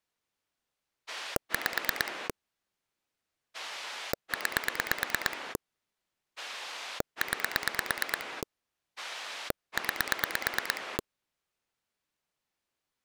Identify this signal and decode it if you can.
Pulse dialling, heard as a rotary dial, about 9 pulses a second. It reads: 5 9 9 9